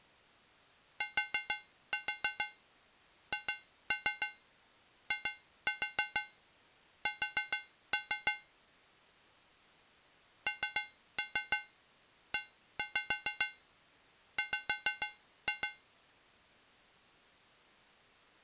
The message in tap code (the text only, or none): THIS NEW